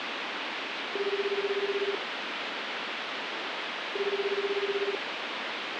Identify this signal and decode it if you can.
Telephone call progress tone (Japanese plan), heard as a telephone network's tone, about 380, 400, 420 Hz, 1 s on and 2 s off, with phone line noise. Ringback tone.